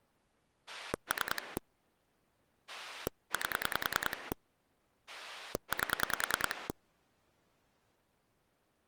Pulse dialling, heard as a rotary dial, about 10 pulses a second. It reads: 3 8 8